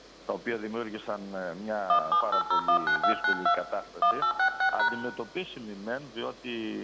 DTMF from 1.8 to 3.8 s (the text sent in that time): 178019292